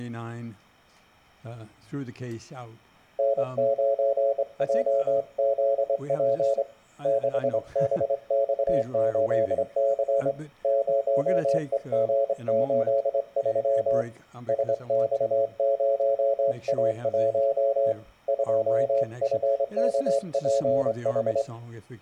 Morse code, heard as a keyed tone, hand-sent with a straight key, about 25 wpm, 550 Hz, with room echo. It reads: N9JZP 6BX8C 0EG83 SX0A1 2FKPH